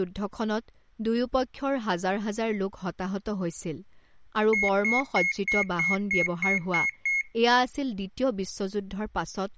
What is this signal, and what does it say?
Beep code, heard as a piezo beeper, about 2150 Hz, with speech in Assamese. 9 short. In AMI BIOS tables: ROM checksum failure.